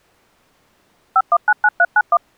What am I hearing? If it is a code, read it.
DTMF, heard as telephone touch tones, dialled by machine, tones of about 50 ms. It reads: 5199391